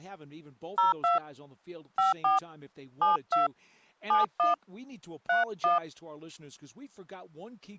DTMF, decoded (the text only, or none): 02 54 72 71 31